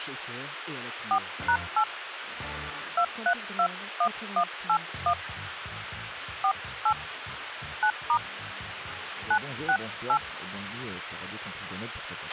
DTMF, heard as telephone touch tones, dialled by hand, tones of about 80 ms, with radio hiss and a squelch burst at the end. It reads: 4#8 2321181 48 9* 968